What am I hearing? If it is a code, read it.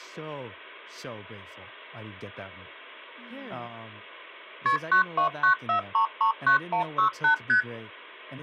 Multi-frequency trunk signalling (R1, as on North American trunks), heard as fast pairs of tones, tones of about 110 ms, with speech in English. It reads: KP 9294339168 ST